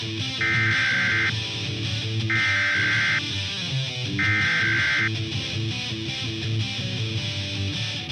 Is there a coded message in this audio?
Yes: Emergency Alert System (SAME) tones (header bursts) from 0.4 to 5.1 s, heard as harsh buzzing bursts, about 520.83 baud.